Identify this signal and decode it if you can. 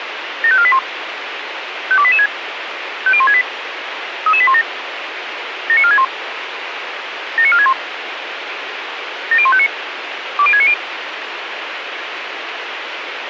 Five-tone selective call (ZVEI), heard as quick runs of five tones, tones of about 70 ms, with radio hiss. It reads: 75481 52886 50168 33817 79461 79461 70159 20690